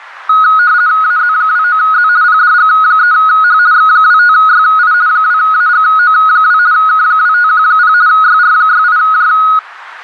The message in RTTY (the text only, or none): AZ29Z PDG3H X25YI 2AGO2 K2510 YR68J